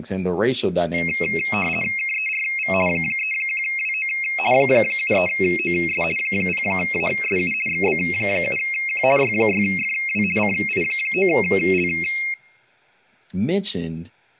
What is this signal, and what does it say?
RTTY (50 baud, 450 Hz shift), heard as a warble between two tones, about 2350 Hz centre, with speech in English. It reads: KERV 31WO 73OS 0ASU XB7Q Y6FW CI9L